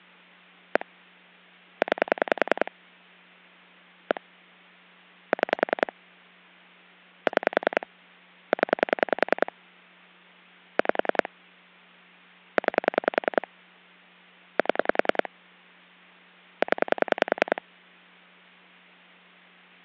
Pulse dialling, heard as clicks on a phone line, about 10 pulses a second. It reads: 1 9 1 6 6 0 5 9 7 0